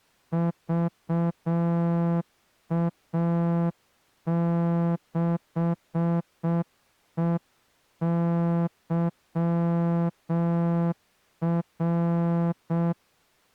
Morse code, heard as a horn, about 6 wpm. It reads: VA6EYR